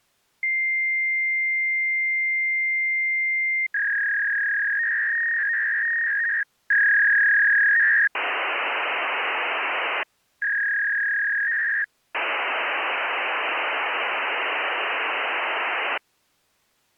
Fax machine handshake, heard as a long tone, a warble and hiss.